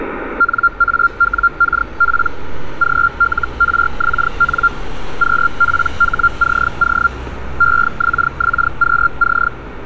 Hellschreiber (Feld-Hell, 122.5 baud), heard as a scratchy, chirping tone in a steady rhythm, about 1390 Hz, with radio static and street noise. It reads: NAWKP GLRXN QPHCO EXXQC